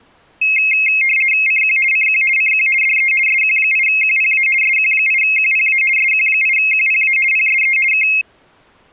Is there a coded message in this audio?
Yes: RTTY (50 baud, 450 Hz shift) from 0.4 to 8.2 s, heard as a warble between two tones, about 2350 Hz centre. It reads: CQ CQ CQ DE SQ8QPA SQ8QPA SQ8QPA PSE K